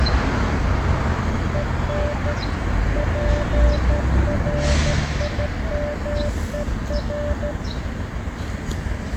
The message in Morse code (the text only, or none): EN PRIMER